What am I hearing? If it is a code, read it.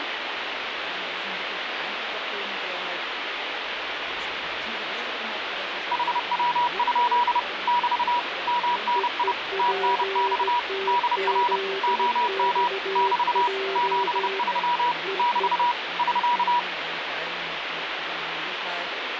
Morse code, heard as two keyed tones, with radio static. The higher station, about 30 wpm, 970 Hz: HW? <BT> MNI TNX DR OM <BT> 73 <BT> <SK>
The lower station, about 17 wpm, 390 Hz: EEPTZXJ EE